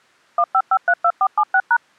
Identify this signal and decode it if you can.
DTMF, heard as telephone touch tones, dialled by machine, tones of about 60 ms. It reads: 15532476#